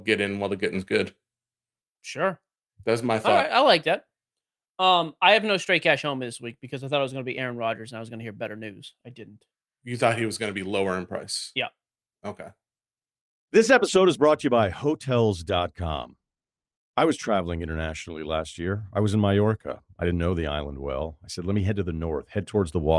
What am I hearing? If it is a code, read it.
Speech in English. There is no code.